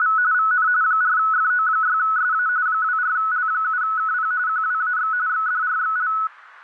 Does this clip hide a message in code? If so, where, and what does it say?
Yes: RTTY (45.45 baud, 170 Hz shift) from 0.0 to 6.3 s, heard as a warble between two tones, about 1380 Hz centre. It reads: … VN 4FO6SA 24L7KP QWAX XDRXL